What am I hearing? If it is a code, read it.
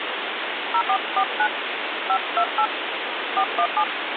DTMF, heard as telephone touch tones, dialled by hand, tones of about 70 ms, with phone line noise. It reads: 0449 528 417